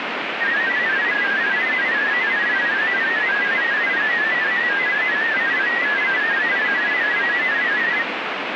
Multi-tone FSK (Olivia or MFSK type), about 500 Hz wide, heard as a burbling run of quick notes, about 31.25 baud, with radio static.